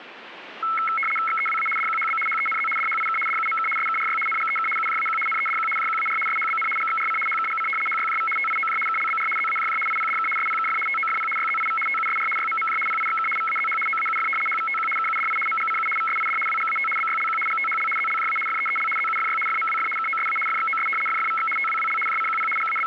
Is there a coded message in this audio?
Yes: RTTY (75 baud, 850 Hz shift) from 0.6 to 22.9 s, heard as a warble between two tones, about 1750 Hz centre, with radio static and static crashes. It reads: XEWA DQHB HENZ DHIK DUMK SKRY NGEK UJAQ NEDQ JQAR SHBN GXRC HKGC HYJV TIOJ KLBR ZAJJ IPDK SPKF TOFP YZIV TUSR YMMJ PIXK VAZH OAUF HVTQ KUDI MGCU VSID WGAT BYLQ GTHL ZLJA FEEL ZUFY FMWF KOSA FXOS FFVX TWWL JCQP …